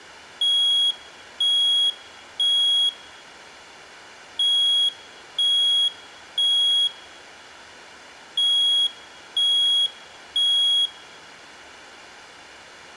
Alarm pattern, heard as an alarm's beeps, played three times, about 3300 Hz, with room echo. Temporal three. Smoke or fire, evacuate.